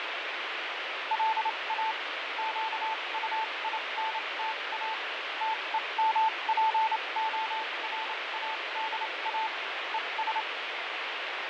Morse code, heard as a keyed tone, machine-sent, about 28 wpm, spaced as for 23 wpm, 880 Hz, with heavy radio static and fading. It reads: LA QUINTA TEMPORADA ES